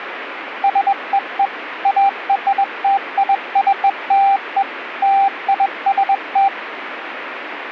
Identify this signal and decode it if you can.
Morse code (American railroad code), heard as a keyed tone, machine-sent, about 790 Hz, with radio static. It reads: SEE ARTICLE LIST